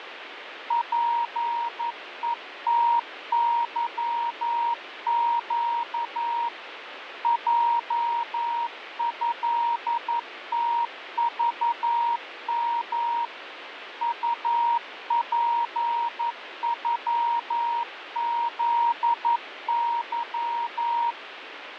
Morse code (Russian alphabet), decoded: ПЕТЫЩ ЙЭТЖМ УПЮЗЫ

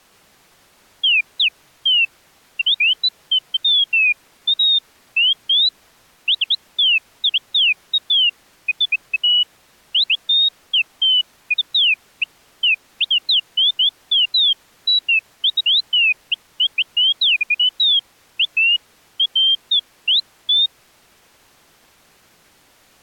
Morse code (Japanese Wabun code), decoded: none

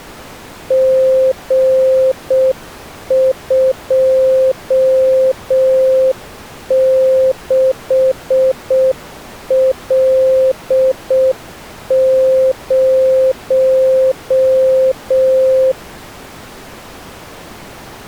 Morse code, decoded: G26L0

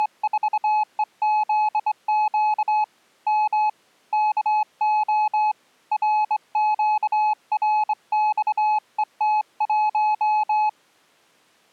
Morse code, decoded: … M KO RQRXET1

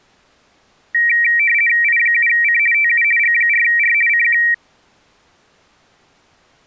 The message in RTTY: I7C TU G4R CQ

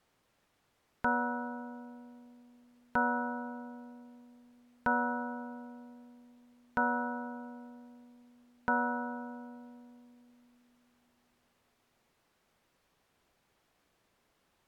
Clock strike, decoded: 5

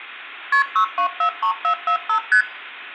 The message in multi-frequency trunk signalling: KP 6243445 ST

